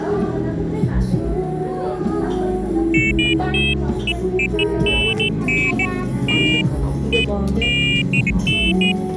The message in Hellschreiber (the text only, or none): none